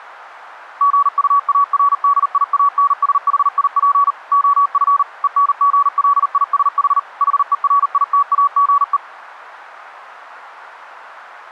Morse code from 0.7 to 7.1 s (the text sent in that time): GUARDIANSHIP OF ENGLISH